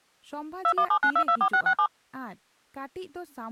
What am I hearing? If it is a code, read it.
DTMF, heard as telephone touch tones, dialled by machine, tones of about 80 ms, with speech in Santali. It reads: 2179224667